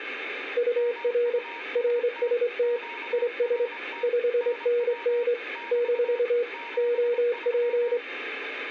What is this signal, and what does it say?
Morse code, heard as two keyed tones, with radio static. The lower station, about 26 wpm, 480 Hz: UR RST IS 5NN - OP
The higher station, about 25 wpm, 940 Hz: MUST QRT NW <BT> 73